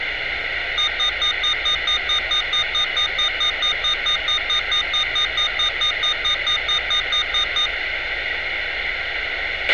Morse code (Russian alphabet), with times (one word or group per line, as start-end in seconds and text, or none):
none